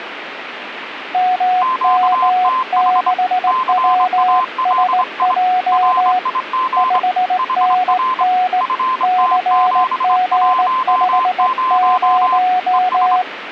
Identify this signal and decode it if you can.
Morse code, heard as two keyed tones, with radio static. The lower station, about 18 wpm, 730 Hz: MM6WSJ 5NN CG50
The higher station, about 24 wpm, 1030 Hz: QTH CALI RIG HR FT710 ES